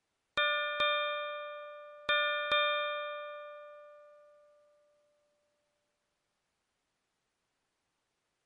Ship's bell, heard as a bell. 4. Four half-hours of the watch have passed.